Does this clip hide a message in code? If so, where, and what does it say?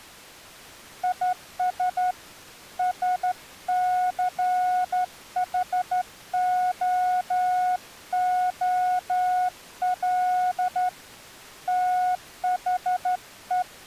Yes: Morse code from 1.0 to 13.7 s, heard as a keyed tone, hand-sent with a straight key, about 12 wpm, 730 Hz. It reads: IS SCHOOL THE